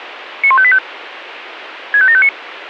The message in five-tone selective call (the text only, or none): 91585 65759